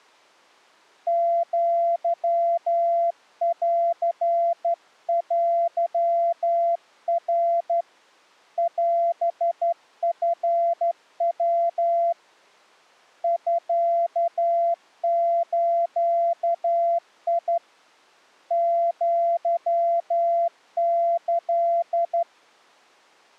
Morse code (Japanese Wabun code), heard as a keyed tone, hand-sent with a straight key, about 12 wpm, 680 Hz. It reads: アンテナ オチヤ ミズ アキ